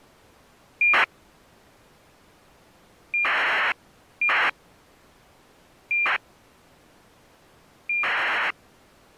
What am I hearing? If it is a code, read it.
ACARS aircraft data, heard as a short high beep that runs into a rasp, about 2400 baud.